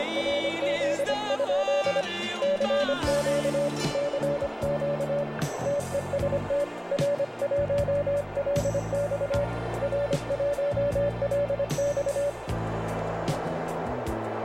Morse code, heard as a keyed tone, hand-sent with a paddle, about 25 wpm, 580 Hz, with heavy radio static and a narrow filter. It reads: … CQ CQ TEST R1LX R1LX